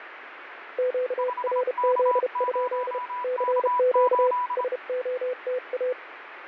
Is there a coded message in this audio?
Yes: Morse code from 0.7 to 6.0 s, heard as two keyed tones, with radio static and fading. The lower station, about 32 wpm, 500 Hz: QRZ? CQ SOTA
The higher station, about 26 wpm, 990 Hz: 5K0K8